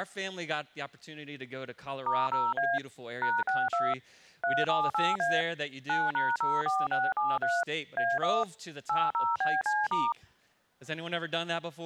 DTMF, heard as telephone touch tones, dialled by machine, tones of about 210 ms. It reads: *0A #62 378A 9#04673 A1 80BC*